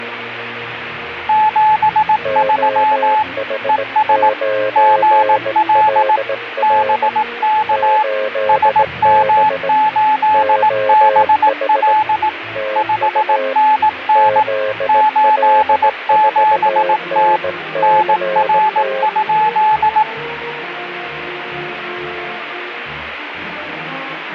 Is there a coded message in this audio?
Yes: Morse code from 1.2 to 20.1 s, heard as two keyed tones, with radio static. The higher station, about 18 wpm, 860 Hz: 73 ES GL BK SM8BL 5NN 87T NR?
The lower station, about 18 wpm, 530 Hz: OH9LR 8B OH TU ZL4NCT